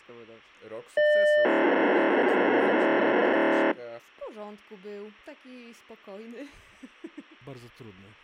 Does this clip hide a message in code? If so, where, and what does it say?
Yes: POCSAG pager data (1200 baud) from 1.0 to 3.7 s, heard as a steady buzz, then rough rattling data.